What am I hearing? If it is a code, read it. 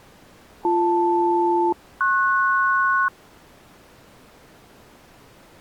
Aircraft SELCAL, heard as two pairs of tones. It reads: BL-PS